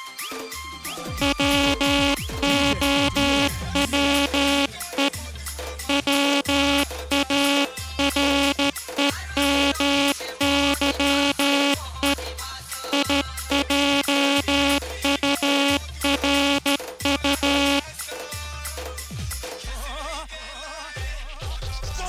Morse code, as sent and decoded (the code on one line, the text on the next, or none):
.-- --- .-- . / .-- .- .-. . -- -.-- . / .. .--- ..- .-. ..-
WOWE WAREMYE IJURU